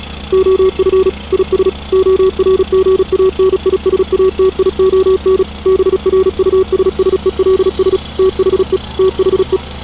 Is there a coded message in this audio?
Yes: Morse code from 0.3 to 9.6 s, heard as a keyed tone, machine-sent, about 36 wpm, 380 Hz, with street noise. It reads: OF IS ORGANISATION BRUSSELS THE THE